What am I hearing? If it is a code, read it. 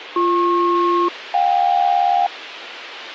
Aircraft SELCAL, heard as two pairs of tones, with radio hiss. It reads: BP-JK